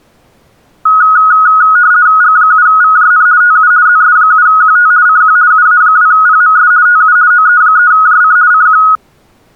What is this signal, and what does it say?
RTTY (50 baud, 170 Hz shift), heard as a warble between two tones, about 1360 Hz centre. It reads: G7VJN TU ZS7QT CQ UA2PMS TU OE3JC CQ